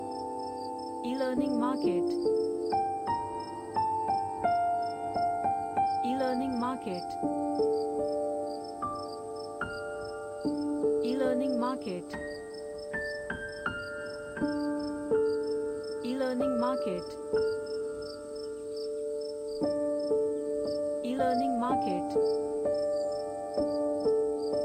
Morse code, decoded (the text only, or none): none